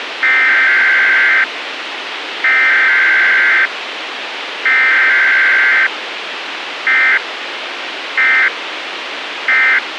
Emergency Alert System (SAME) tones (header bursts, then end-of-message bursts), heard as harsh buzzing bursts, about 520.83 baud, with radio hiss.